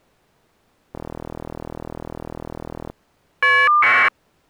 Caller ID data burst, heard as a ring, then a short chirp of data, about 1200 baud.